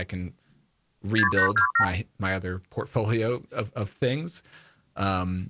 Multi-frequency trunk signalling (R2, with the far end's replies), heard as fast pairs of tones, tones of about 100 ms, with speech in English. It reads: 6827